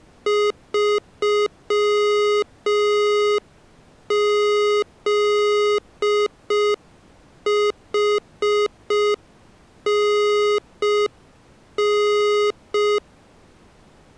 Morse code, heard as electronic beeps, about 5 wpm, 420 Hz. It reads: 3ZHNN